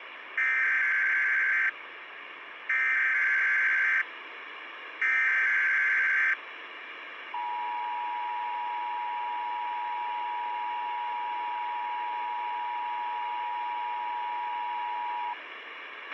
Emergency Alert System (SAME) tones (header bursts, then the 853 and 960 Hz attention tone), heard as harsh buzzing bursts, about 520.83 baud, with radio hiss and a squelch burst at the end.